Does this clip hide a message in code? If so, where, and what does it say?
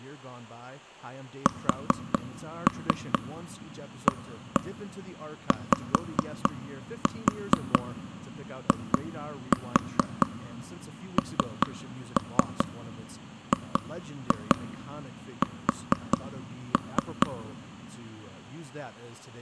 Yes: tap code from 1.5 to 17.3 s, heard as taps on a table, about 4 knocks a second, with speech in English. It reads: SAYINGS